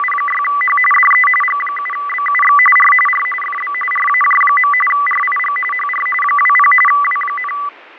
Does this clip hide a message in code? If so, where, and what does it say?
Yes: RTTY (45.45 baud, 850 Hz shift) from 0.0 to 7.7 s, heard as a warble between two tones, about 1600 Hz centre, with radio static and fading. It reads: … DE G7BUX R R FB RAJ. RIG HR 20 W,